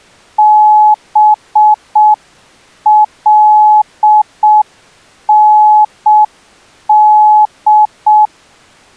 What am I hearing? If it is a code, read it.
Morse code (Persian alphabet), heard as a keyed tone, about 6 wpm, 850 Hz. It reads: بلند